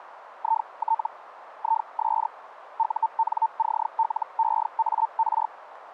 Hellschreiber (Feld-Hell, 122.5 baud), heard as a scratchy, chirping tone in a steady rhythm, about 900 Hz, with radio static and a narrow filter. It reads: IT IS UNCLEAR